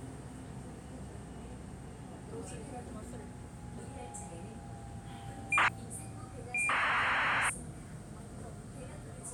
ACARS aircraft data, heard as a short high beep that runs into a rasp, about 2400 baud, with the noise inside a subway train.